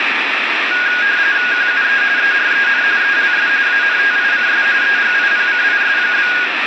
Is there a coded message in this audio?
Yes: RTTY (45.45 baud, 170 Hz shift) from 0.7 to 6.5 s, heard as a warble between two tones, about 1550 Hz centre, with radio static. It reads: QUE EREN ELS ANTICS EGIPCIS?